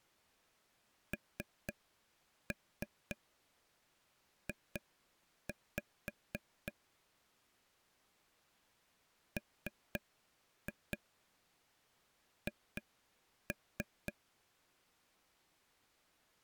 Tap code, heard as taps on a table, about 3 knocks a second. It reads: NJ MH